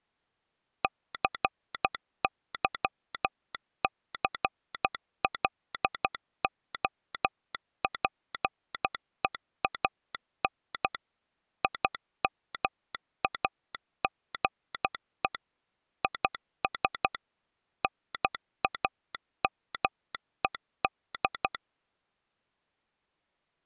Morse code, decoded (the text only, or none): CYCLOPEAN IMAGE IS NAMED